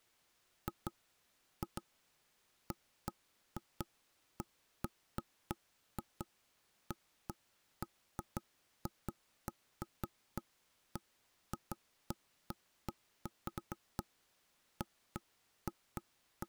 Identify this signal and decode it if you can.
Irregular knocks on wood. There is no code.